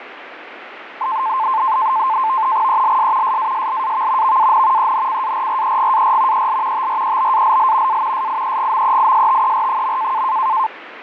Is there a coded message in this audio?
Yes: NAVTEX (SITOR-B), 100 baud, 170 Hz shift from 1.0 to 10.7 s, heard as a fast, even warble, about 970 Hz centre, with radio static. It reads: ELS SASLAV VAN ENCARREGAR EL TREBALL A SIEGMEISTER.